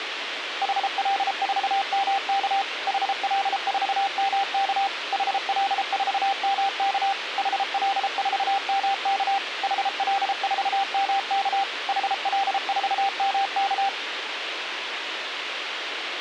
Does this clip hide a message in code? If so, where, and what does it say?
Yes: Morse code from 0.6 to 13.9 s, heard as a keyed tone, machine-sent, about 33 wpm, 790 Hz, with radio hiss. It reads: HL4MK HL4MK HL4MK HL4MK HL4MK HL4MK